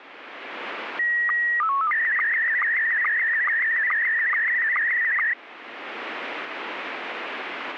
SSTV (slow-scan television), Scottie S1, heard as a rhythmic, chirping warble.